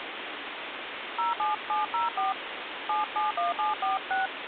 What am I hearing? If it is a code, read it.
DTMF, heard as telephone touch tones, dialled by hand, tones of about 150 ms, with phone line noise. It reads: 07704 771746